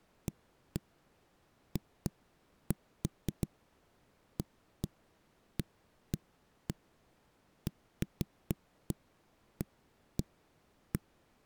Irregular knocks on a wall. There is no code.